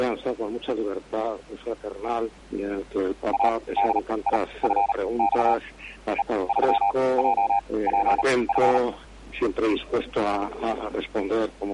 Morse code, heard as a keyed tone, machine-sent, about 38 wpm, spaced as for 22 wpm, 800 Hz. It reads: ADIFX E3JPF